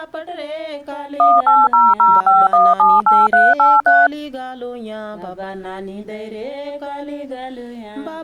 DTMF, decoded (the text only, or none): 18005178383